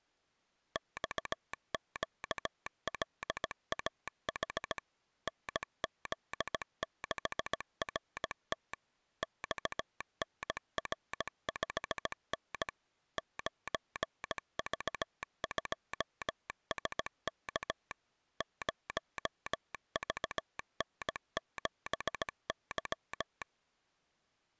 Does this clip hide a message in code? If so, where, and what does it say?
Yes: Morse code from 0.7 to 23.5 s, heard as a telegraph sounder, machine-sent, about 17 wpm. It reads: XQLAH NZ6RT XNR5N 9V2SK 0VN7Y